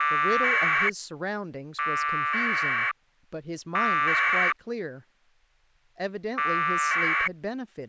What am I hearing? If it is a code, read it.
Packet radio (AX.25, as in APRS), 1200 baud, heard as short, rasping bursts, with speech in English.